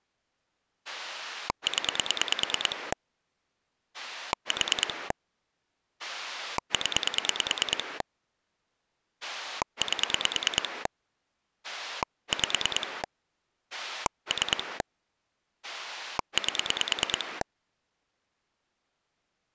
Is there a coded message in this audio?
Yes: pulse dialling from 0.9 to 17.4 s, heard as a rotary dial, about 9 pulses a second. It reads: 0 4 0 8 5 3 8